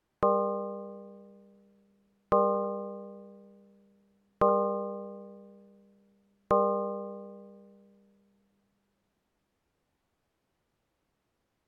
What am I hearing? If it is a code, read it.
Clock strike, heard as a bell. 4. Four o'clock.